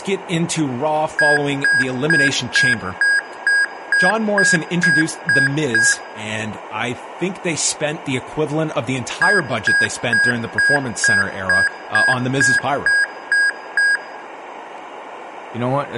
Beep code, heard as beeps from a small speaker, played twice, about 1650 Hz, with room echo and speech in English. 11 short. In AMI BIOS tables: cache memory error.